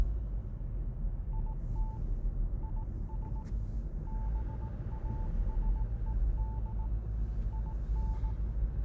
Morse code, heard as a keyed tone, hand-sent with a paddle, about 18 wpm, 880 Hz, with the noise inside a car. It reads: IT IS BASED IN